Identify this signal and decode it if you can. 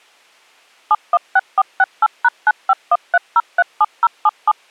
DTMF, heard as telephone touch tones, dialled by machine, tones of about 40 ms. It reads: 716468#9513037077